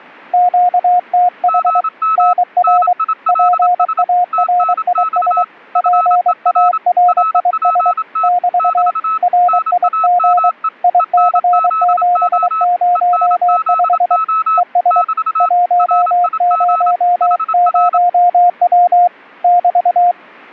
Morse code, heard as two keyed tones. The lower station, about 23 wpm, 710 Hz: QTH NR PARIS PARIS <BT> RIG IC705 ES 100W <BT>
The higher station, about 27 wpm, 1300 Hz: GM NILS TNX FER RPT <BT> NAME ENZO ENZO <BT> RIG HR